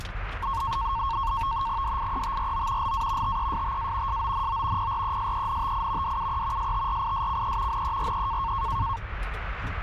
NAVTEX (SITOR-B), 100 baud, 170 Hz shift, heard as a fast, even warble, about 1000 Hz centre, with radio static and the noise inside a car. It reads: DIETRO LA TESTA SONO PRESENTI DUE STRISCE NERE